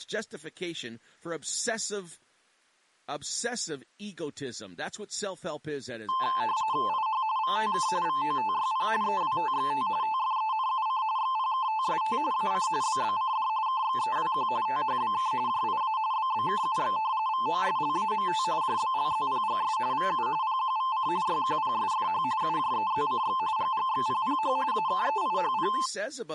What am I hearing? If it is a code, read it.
RTTY (45.45 baud, 170 Hz shift), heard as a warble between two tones, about 960 Hz centre, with speech in English. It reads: IH VTK VOTYP EWTXT TFENUC XPKTST AC BBCD KXEWQ THBK JIA BBKUX VOSLAMT JBLZPGS VU PQVC YQPSFH UJEZCX GGXPPH AKEIHP